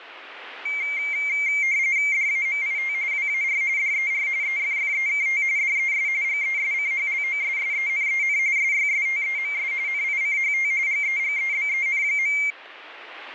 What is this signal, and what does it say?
RTTY (45.45 baud, 170 Hz shift), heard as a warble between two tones, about 2200 Hz centre, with radio static. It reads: DAMIT WAR DER EFFEKT DES GESCHLOSSENEN SYSTEMS NICHT GEGEBEN.